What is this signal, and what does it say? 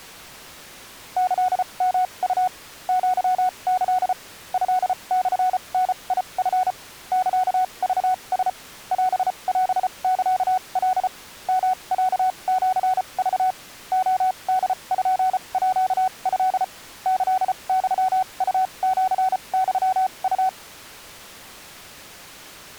Morse code (Japanese Wabun code), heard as a keyed tone, machine-sent, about 34 wpm, spaced as for 27 wpm, 740 Hz. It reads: キヨウ アキ トモダチ サクラ オオサカ ヨロシク レポート キユウシユウ